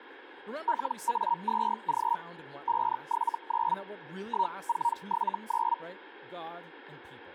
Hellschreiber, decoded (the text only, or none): LA2G 579 1479